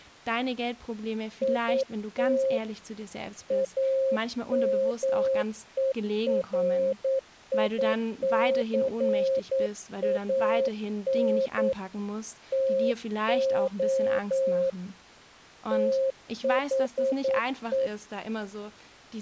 Morse code, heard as a keyed tone, hand-sent with a paddle, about 9 wpm, 530 Hz, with speech in German. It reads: IT AMERICAN TO THE